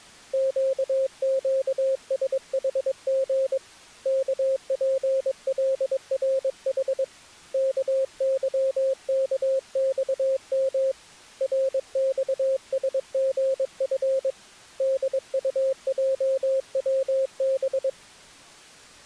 Morse code, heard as a keyed tone, hand-sent with a paddle, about 22 wpm, 530 Hz. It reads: QQSHG KPLRH KYKXM RXSGF DUJWB